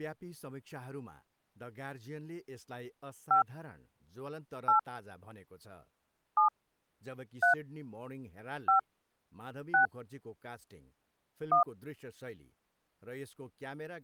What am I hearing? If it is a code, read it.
DTMF, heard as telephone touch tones, dialled by hand, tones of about 120 ms, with speech in Nepali. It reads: 5 8 7 3 5 6 1